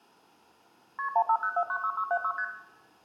Multi-frequency trunk signalling (R1, as on North American trunks), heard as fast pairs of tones, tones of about 70 ms, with room echo. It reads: KP 150496676 ST